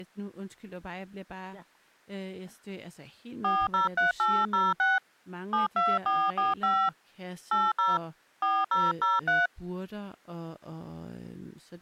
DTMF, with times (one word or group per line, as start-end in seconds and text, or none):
3.4-5.0 403806
5.5-6.9 72445
7.5-8.0 80
8.4-9.5 4003